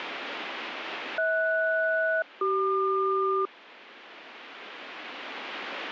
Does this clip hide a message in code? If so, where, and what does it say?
Yes: aircraft SELCAL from 1.2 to 3.5 s, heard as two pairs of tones. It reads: HS-CQ